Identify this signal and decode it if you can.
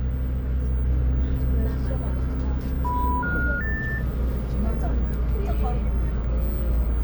Telephone call progress tone (North American plan), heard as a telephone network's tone, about 980, 1430, 1800 Hz, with the noise inside a bus. Special information tone.